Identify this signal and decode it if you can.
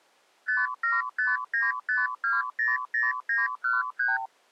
Multi-frequency trunk signalling (R2, with the far end's replies), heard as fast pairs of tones, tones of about 180 ms. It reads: 57595200913